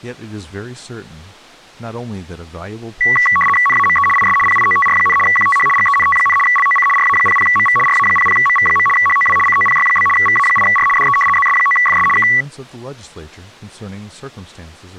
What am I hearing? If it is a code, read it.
RTTY (75 baud, 850 Hz shift), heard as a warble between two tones, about 1550 Hz centre, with speech in English. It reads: NAME IS PIOTR, QTH GENT, LOC RA00MV RA00MV. HOW COPY? VA8R DE ZS9FS K